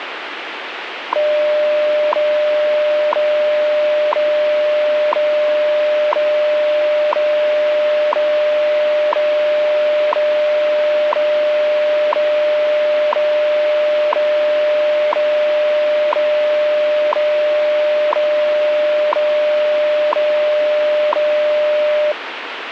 Radio time signal (WWV, Colorado), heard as ticks, one a second, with radio static.